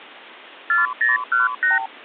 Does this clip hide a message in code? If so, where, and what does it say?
Yes: multi-frequency trunk signalling (R2, with the far end's replies) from 0.7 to 1.9 s, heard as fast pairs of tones, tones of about 160 ms. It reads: 4018